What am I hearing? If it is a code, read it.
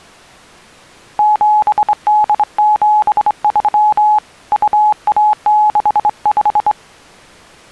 Morse code (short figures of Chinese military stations), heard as a keyed tone, hand-sent with a straight key, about 24 wpm, 850 Hz. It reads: 7873 2165